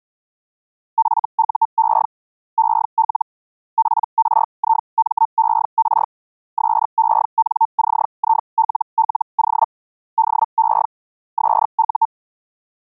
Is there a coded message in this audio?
Yes: Hellschreiber (Feld-Hell, 122.5 baud) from 1.0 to 12.1 s, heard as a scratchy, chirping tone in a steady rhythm, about 900 Hz. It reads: FUE EL PRIMER SENCILLO DE SU